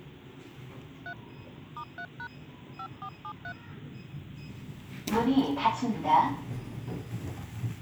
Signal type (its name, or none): DTMF